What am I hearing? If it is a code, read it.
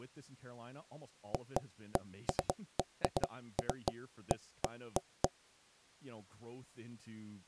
Irregular knocks on wood, with speech in English. There is no code.